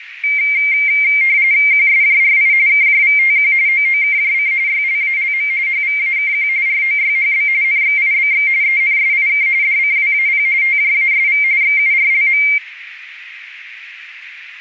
RTTY (45.45 baud, 170 Hz shift), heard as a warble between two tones, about 2200 Hz centre, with radio static and a narrow filter. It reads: QSJRI KJVTQ OOKJC YLALM HVAKQ ROYHB NXIBX ENSIK DCWAP TJASV XURLM